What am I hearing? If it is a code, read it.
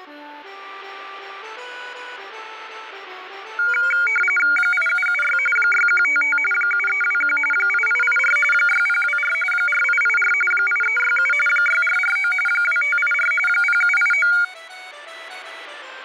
RTTY (45.45 baud, 850 Hz shift), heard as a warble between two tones, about 1850 Hz centre. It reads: 8776 6155 7321 8884 6024 4884 8367 6449 2584 0789